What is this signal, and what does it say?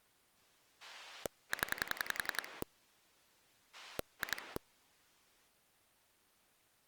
Pulse dialling, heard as a rotary dial, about 11 pulses a second. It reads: 0 2